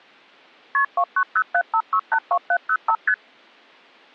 Multi-frequency trunk signalling (R1, as on North American trunks), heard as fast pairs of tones, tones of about 70 ms. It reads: KP 29075682705 ST